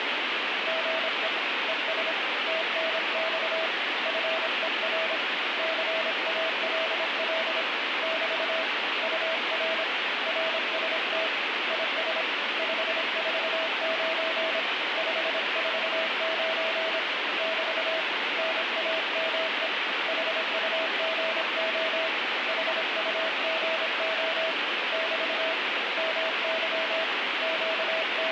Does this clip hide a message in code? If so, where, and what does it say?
Yes: Morse code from 0.6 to 28.3 s, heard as a keyed tone, hand-sent with a paddle, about 26 wpm, 650 Hz, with heavy radio static. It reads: GE ES TNX FER CALL <BT> UR RST IS 549 549 <BT> NAME HUGO HUGO <BT> MY …